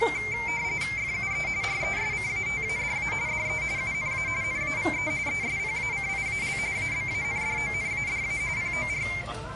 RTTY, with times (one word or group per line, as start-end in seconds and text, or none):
1.0-1.5 FUE
1.6-3.1 RESCATADA
3.3-3.6 DE
3.8-4.3 UNA
4.4-5.1 NAVE
5.3-6.6 ESPACIAL
6.8-8.4 ABANDONADA
8.6-9.1 POR